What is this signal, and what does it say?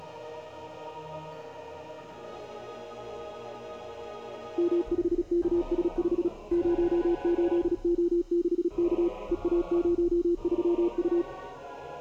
Morse code, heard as a keyed tone, machine-sent, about 36 wpm, 340 Hz. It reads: M5KS5 08O6K EA03U